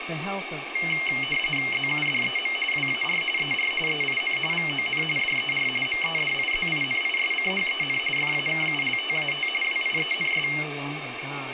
RTTY (45.45 baud, 850 Hz shift), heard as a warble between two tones, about 2550 Hz centre, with radio static and speech in English. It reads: ZUDEM WAR ER EIN VON DER MEDIZINISCHEN FAKULTAT WIENS